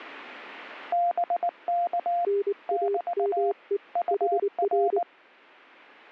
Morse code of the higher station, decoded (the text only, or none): BK <BT> UR